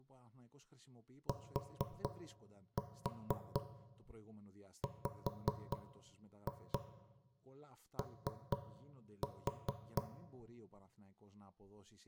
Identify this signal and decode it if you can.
Tap code, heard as knocks on wood, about 4 knocks a second, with room echo and speech in Greek. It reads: TWO